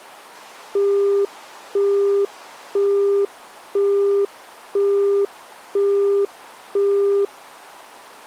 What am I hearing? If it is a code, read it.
Telephone call progress tone (single-tone plan, as in Europe, Japan and elsewhere), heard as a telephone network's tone, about 400 Hz, 0.5 s on and 0.5 s off. Busy tone.